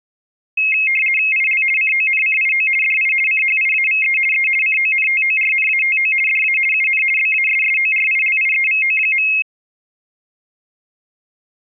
RTTY (50 baud, 450 Hz shift), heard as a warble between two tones, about 2350 Hz centre. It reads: IL CONCIO DI CHIAVE E CONTORNATO DA UN BASSORILIEVO.